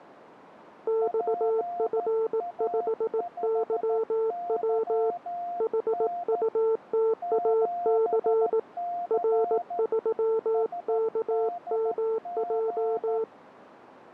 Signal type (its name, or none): Morse code